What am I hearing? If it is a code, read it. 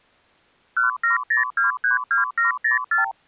Multi-frequency trunk signalling (R2, with the far end's replies), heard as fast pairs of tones, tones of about 130 ms. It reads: 170232704